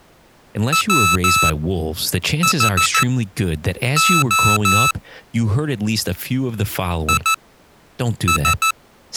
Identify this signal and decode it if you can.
Morse code, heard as electronic beeps, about 14 wpm, spaced as for 7 wpm, 1310 Hz, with speech in English. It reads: WHO IS